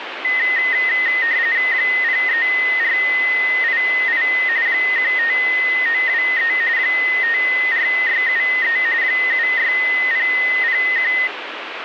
RTTY (45.45 baud, 170 Hz shift), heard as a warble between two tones, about 1950 Hz centre, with radio static. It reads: 03488 15923 54673 76001